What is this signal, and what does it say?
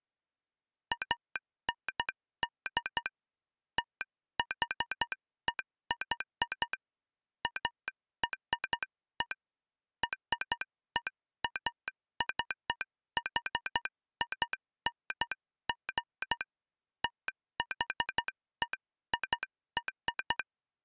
Morse code (American railroad code), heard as a telegraph sounder, hand-sent with a straight key. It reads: AND THEY ARE REACHING THEIR